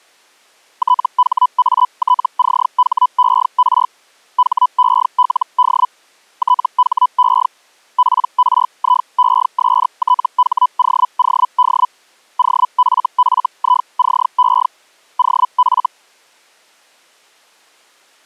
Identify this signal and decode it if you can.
Hellschreiber (Feld-Hell, 122.5 baud), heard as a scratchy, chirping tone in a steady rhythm, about 1000 Hz. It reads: THATCHER HELD THE PRIESTHOOD OFFICE OF